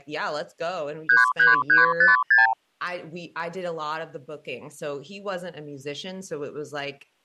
Multi-frequency trunk signalling (R2, with the far end's replies), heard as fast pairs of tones, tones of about 150 ms, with speech in English. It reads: 33356